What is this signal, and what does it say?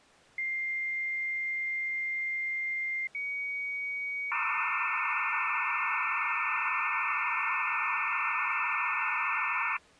Dial-up modem handshake (low-speed, two carriers), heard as two whistles, then hiss.